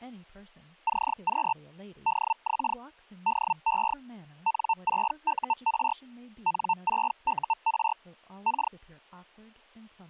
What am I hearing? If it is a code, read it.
Hellschreiber (Feld-Hell, 122.5 baud), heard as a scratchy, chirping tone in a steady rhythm, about 900 Hz, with speech in English. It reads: CQ DX DE N6UR N6UR K